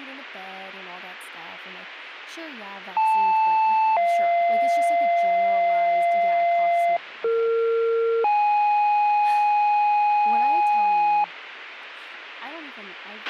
Two-tone page, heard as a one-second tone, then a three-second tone, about 880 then 690 Hz, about 460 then 830 Hz, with a squelch burst at the end and speech in English.